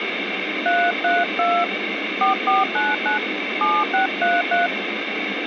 DTMF, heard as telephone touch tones, dialled by hand, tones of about 200 ms, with phone line noise. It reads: 332 4499 7633